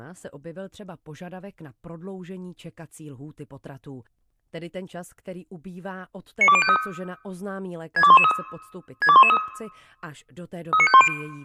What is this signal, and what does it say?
Five-tone selective call (ZVEI), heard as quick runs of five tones, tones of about 70 ms, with speech in Czech. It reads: 92053 62113 62113 39510